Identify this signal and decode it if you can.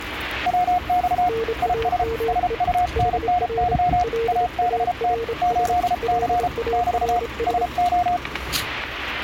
Morse code, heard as two keyed tones, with static crashes and street noise. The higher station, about 33 wpm, 720 Hz: WX IS SUNNY ABT 8C <BT> SO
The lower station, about 27 wpm, 460 Hz: NAME HR LARS LARS